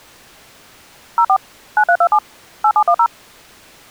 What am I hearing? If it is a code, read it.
DTMF, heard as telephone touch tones, dialled by machine, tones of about 70 ms. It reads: 04 9327 8710